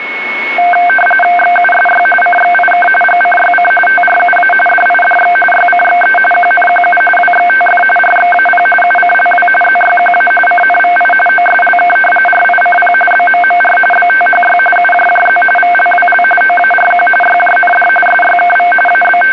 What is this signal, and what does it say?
RTTY (45.45 baud, 850 Hz shift), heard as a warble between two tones, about 1130 Hz centre, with radio static and a steady whistle near 2200 Hz. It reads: XUSY CXIK GCYC TRUA DIDX YCXE QNQU WXTF RXAP UCLW ZYQA CNVI OSLK RICP BMMR BTHY UJJZ VLWL OARQ YJND SYKV …